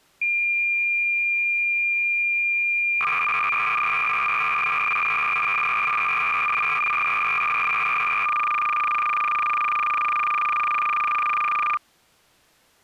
Cassette data (Kansas City type), 300 baud, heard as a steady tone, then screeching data.